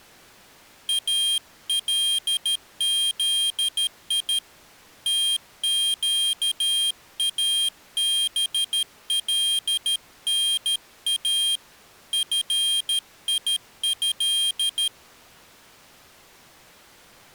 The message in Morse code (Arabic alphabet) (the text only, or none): الذي تقابلنا فيه